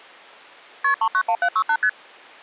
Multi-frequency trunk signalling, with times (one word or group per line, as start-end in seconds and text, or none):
0.8-0.9 KP
1.0-1.8 391768
1.8-1.9 ST